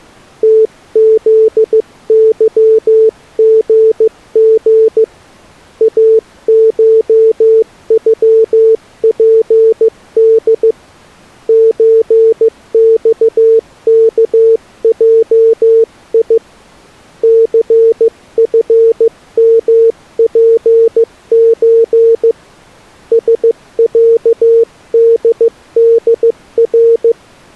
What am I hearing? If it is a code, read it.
Morse code (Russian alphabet), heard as a keyed tone, hand-sent with a paddle, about 15 wpm, 450 Hz. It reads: ТЗЫГГ АШЮПД ЧЬКЙИ ЦФМПЧ СЯДДР